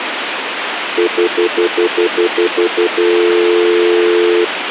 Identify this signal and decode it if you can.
Telephone call progress tone (North American plan), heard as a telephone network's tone, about 350, 440 Hz, 0.1 s on and 0.1 s off, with phone line noise. Stutter dial tone.